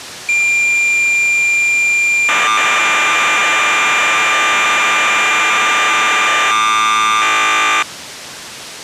Cassette data (Kansas City type), 1200 baud, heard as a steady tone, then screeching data.